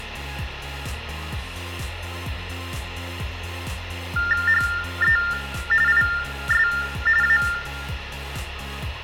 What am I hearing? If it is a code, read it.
TTY/TDD text telephone tones (45.45 baud Baudot), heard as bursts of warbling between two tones, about 400 Hz shift, 1600 Hz centre, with phone line noise and room echo. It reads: HE IS A